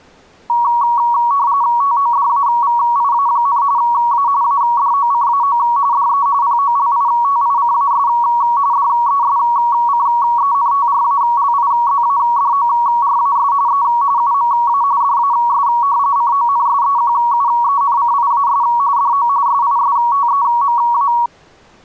RTTY (45.45 baud, 170 Hz shift), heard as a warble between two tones, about 1030 Hz centre. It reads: TODAVIA, A ADOCAO DE POLITICAS DESCENTRALIZADORAS E UMA DAS CONSEQUENCIAS DO SISTEMA